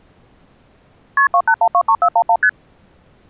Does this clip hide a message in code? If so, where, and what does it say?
Yes: multi-frequency trunk signalling (R1, as on North American trunks) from 1.2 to 2.5 s, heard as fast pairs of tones, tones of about 70 ms. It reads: KP 28123411 ST